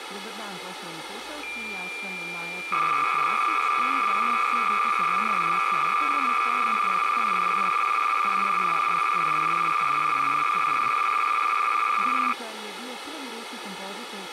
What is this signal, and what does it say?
Cassette data (Kansas City type), 300 baud, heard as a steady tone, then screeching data, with tape hiss.